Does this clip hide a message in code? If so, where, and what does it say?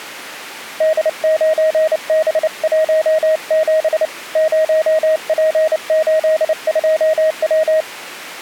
Yes: Morse code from 0.7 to 7.9 s, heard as a keyed tone, hand-sent with a paddle, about 29 wpm, 630 Hz. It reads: D9B17 0P82W